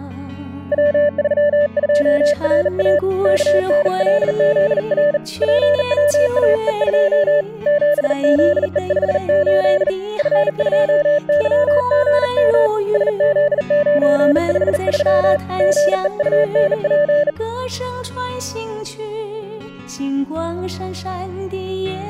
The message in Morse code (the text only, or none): W32RA KNLZR PWAE2 7ZE58 F2YGM SZ953 GEUNP